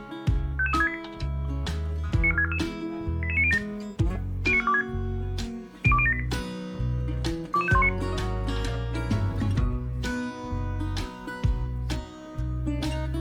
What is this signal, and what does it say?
Five-tone selective call (ZVEI), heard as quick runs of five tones, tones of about 70 ms, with room echo. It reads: 55368 94644 88907 09426 02078 22519